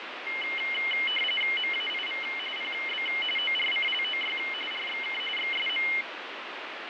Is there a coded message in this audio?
Yes: RTTY (45.45 baud, 850 Hz shift) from 0.3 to 6.0 s, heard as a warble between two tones, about 2550 Hz centre, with radio static. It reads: MAIV PB ORCLOY RXK XSM